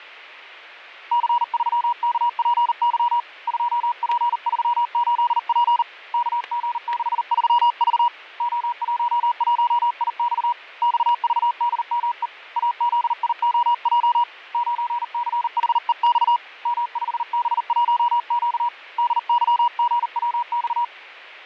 Morse code, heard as a keyed tone, hand-sent with a paddle, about 39 wpm, 960 Hz, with fading and static crashes. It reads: C3KPY 2P38P KG63V O11IX XVDME AZIOJ 9CHEX M5B1Q DYGWX